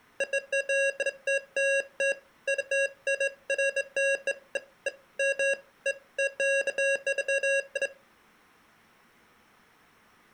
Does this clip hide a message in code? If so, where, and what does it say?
No, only beeps of irregular length.